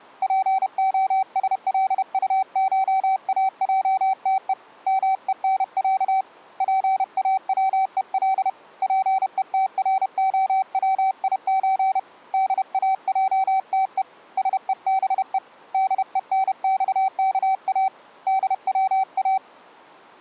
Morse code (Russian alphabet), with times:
0.2-4.5 ПОСЛУШАЙТЕ
4.9-6.2 МЕНЯ
6.6-8.5 ПАВЕЛ
8.8-12.0 ПЕТРОВИЧ
12.3-14.0 ДАЙТЕ
14.4-15.4 СЕБЕ
15.7-17.9 ДЕНЬКА
18.3-19.4 ДВА

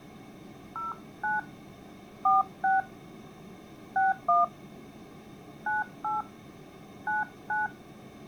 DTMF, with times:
0.8-1.4 09
2.2-2.8 46
4.0-4.4 61
5.7-6.2 98
7.1-7.7 99

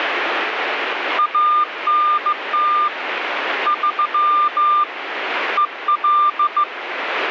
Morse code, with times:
1.2-2.9 ANT
3.7-4.8 3
5.6-6.6 EL

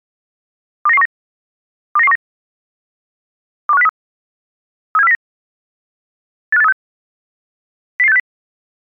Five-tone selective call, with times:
0.9-1.1 29919
2.0-2.2 29919
3.7-3.9 21503
5.0-5.2 37409
6.5-6.7 85836
8.0-8.2 00860

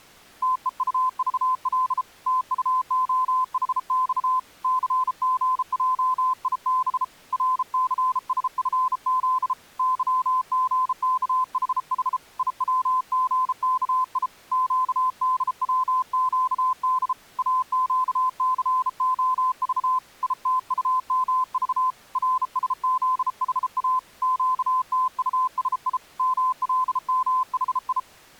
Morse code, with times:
0.4-2.0 TEUVL
2.3-4.4 TUOHX
4.6-7.0 CGJIB
7.3-9.5 RCSFZ
9.8-12.2 YGKHH
12.4-14.3 IWGKI
14.5-17.1 QDWQD
17.4-20.0 AQCOV
20.2-21.9 ITUMV
22.2-24.0 RSZHA
24.2-26.0 QTUSI
26.2-28.0 MLMHI

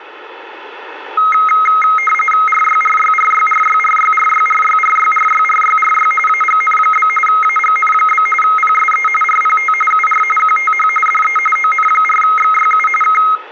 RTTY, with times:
2.5-6.1 RYRYRYRYRYRYRYRYRYRYRY
6.3-7.1 AGN?
7.3-8.3 AGN?
8.4-9.1 PSE
9.2-9.7 RPT
9.9-10.2 UR
10.4-10.9 QTH
11.1-11.4 DE
11.6-12.9 ON4XYU
13.0-13.2 K

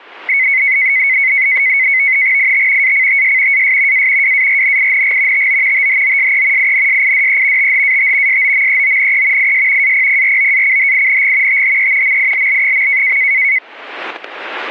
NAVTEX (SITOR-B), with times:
2.4-2.9 IT
2.8-3.6 ACTS
3.5-4.1 AS
3.9-4.3 A
4.2-5.5 WARNING
5.3-5.9 TO
5.7-6.7 THOSE
6.6-7.7 INSIDE
7.6-8.4 THAT
8.3-9.5 SOMEONE
9.4-9.9 IS
9.8-11.6 APPROACHING
11.5-12.2 THE
12.0-13.2 MILL.

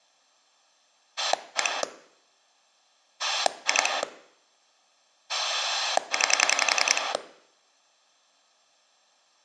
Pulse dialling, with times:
1.2-1.8 1
3.2-4.0 2
5.3-7.1 9

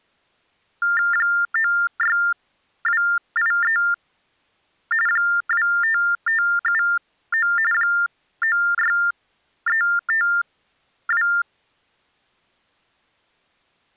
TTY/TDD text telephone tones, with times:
1.1-3.8 96283
5.1-7.5 25579
7.7-11.3 96352

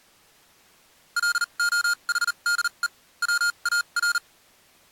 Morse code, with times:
1.2-2.9 LOHDE
3.2-4.2 WAR

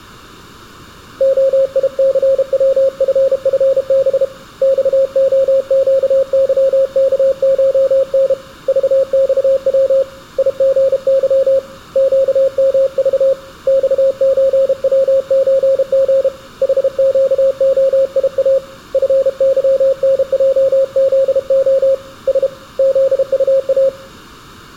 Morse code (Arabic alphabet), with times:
1.2-4.2 خيثوففب
4.6-8.3 صخقظكشن
8.7-10.0 ضصو
10.4-11.6 يغظ
12.0-13.3 قمض
13.7-16.3 صزوزغ
16.6-18.6 حقخيا
18.9-21.9 فظنجذخ
22.3-22.5 س
22.8-23.9 ذطا

